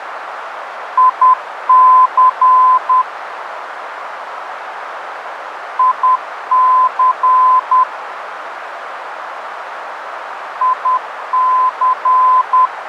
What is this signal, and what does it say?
Morse code, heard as a keyed tone, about 10 wpm, 1020 Hz, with radio static and a narrow filter. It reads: IC IC IC